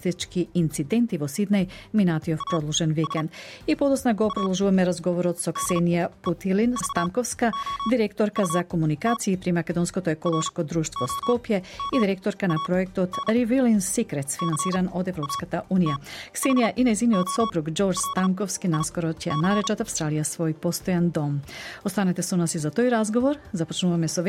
Morse code, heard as a keyed tone, machine-sent, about 36 wpm, spaced as for 15 wpm, 1120 Hz. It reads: AS A DEVOUT ROMAN CATHOLIC